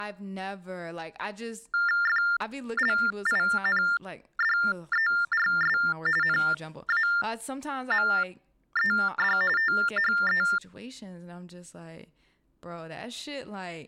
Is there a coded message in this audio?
Yes: TTY/TDD text telephone tones (45.45 baud Baudot) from 1.7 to 10.6 s, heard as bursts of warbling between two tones, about 400 Hz shift, 1600 Hz centre, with speech in English. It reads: FLINDERS NAMED THE